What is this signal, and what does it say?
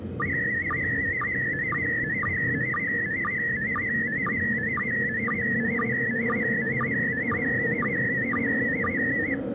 SSTV (slow-scan television), PD 120, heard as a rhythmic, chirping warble, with the noise inside a subway train.